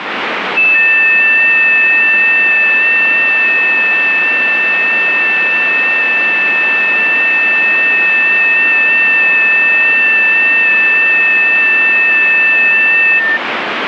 FT8 (several signals at once), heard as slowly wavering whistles, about 6.25 baud, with radio static.